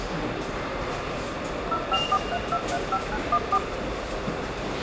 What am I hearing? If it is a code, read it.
DTMF, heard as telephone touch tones, dialled by machine, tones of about 60 ms, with radio hiss, room echo and the noise of a subway station. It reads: 0543235914